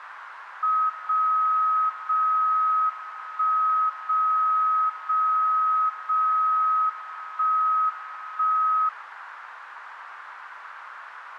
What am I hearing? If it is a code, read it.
Radio time signal (WWVB), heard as a tone whose level steps once a second, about 1270 Hz, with radio static. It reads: 0 0 1 0 0 0 1 1